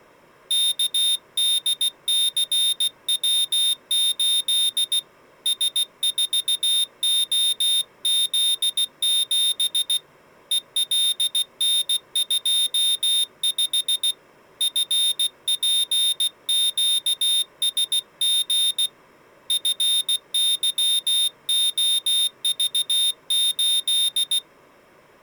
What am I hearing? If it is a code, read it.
Morse code, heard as a high beeper, hand-sent with a paddle, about 16 wpm, 3650 Hz. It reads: KDCW8 S4OZ7 ELN25 FPQSG FYOV8